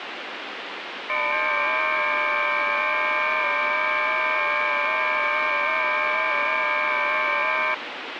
FT8 (several signals at once), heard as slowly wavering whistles, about 6.25 baud, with radio static.